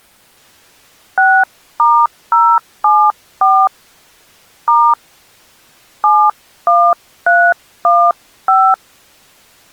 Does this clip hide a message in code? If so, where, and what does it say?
Yes: DTMF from 1.2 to 8.7 s, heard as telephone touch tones, dialled by hand, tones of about 260 ms. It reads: 6*074 * 71315